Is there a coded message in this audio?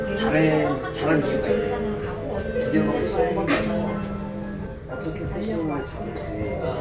No, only the noise of a crowd indoors.